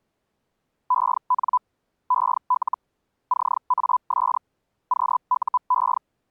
Hellschreiber (Feld-Hell, 122.5 baud), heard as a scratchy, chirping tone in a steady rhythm, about 1000 Hz. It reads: EN EL CAS QUE